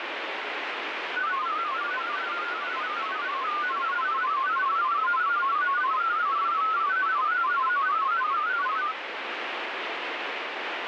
Multi-tone FSK (Olivia or MFSK type), about 500 Hz wide, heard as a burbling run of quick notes, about 31.25 baud, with radio static.